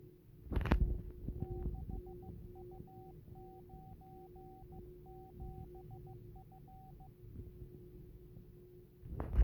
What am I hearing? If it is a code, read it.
Morse code, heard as a keyed tone, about 15 wpm, 760 Hz, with the noise inside a lift. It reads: 6U97F